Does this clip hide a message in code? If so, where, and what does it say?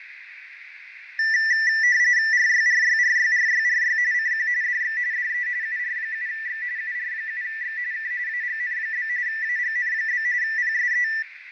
Yes: RTTY (45.45 baud, 170 Hz shift) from 1.2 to 11.2 s, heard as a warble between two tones, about 1850 Hz centre, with radio static, fading and a narrow filter. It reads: RYRYRYRYRY CQ DX DE UR7X UR7X K AGN? AGN? PSE